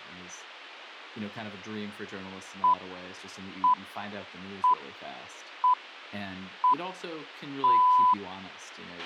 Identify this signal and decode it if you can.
Radio time signal (six pips, as the Greenwich Time Signal), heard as pips, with a squelch burst at the end and speech in English.